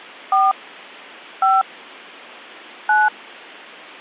DTMF, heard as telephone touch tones, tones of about 200 ms. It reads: 4 5 9